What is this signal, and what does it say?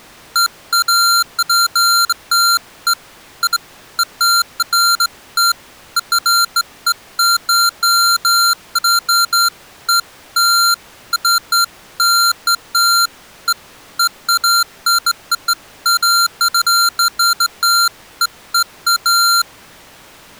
Beeps of irregular length. There is no code.